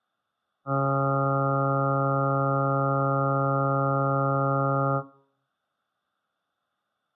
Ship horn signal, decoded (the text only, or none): 1 long